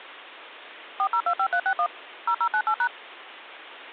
DTMF, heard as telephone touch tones, dialled by machine, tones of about 70 ms. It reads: 4025361 0098#